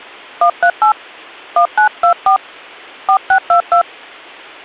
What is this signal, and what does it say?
DTMF, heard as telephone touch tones, dialled by hand, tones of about 90 ms. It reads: 138 1924 4622